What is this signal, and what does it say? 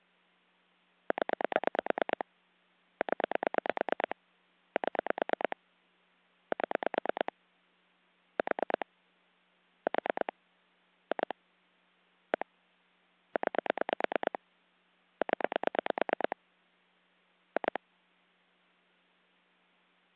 Pulse dialling, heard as clicks on a phone line, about 9 pulses a second. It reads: 0 0 7 7 4 4 2 1 9 0 2